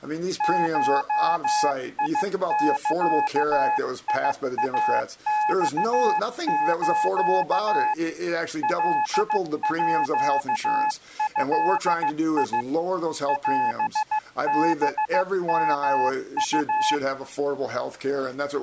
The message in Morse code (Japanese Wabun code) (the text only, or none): ゴザイマス カード オハヨウ